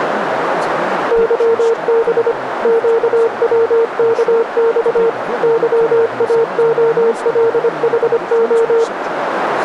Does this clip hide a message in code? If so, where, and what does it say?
Yes: Morse code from 1.1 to 8.9 s, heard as a keyed tone, machine-sent, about 25 wpm, 460 Hz, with radio static, a narrow filter and speech in English. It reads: YB QWKX YAOLHO